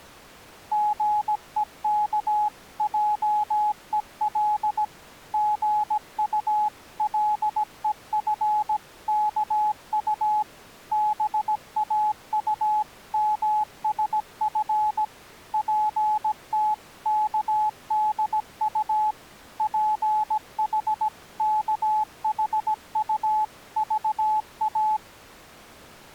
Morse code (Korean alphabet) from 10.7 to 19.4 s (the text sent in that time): 되면 저의